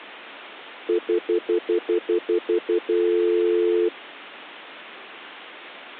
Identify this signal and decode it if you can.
Telephone call progress tone (North American plan), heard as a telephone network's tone, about 350, 440 Hz, 0.1 s on and 0.1 s off. Stutter dial tone.